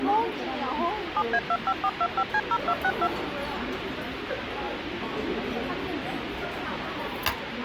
DTMF, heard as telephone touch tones, dialled by machine, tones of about 60 ms, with phone line noise and the noise of a restaurant. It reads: 7A25425C0262